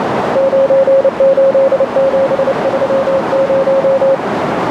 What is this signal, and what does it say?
Morse code, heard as a keyed tone, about 29 wpm, 540 Hz, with heavy radio static and a narrow filter. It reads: 98730